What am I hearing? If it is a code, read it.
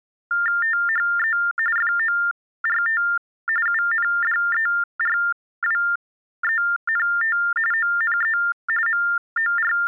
TTY/TDD text telephone tones (45.45 baud Baudot), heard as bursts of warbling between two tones, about 400 Hz shift, 1600 Hz centre. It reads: THE FORT UNDERWENT ONE …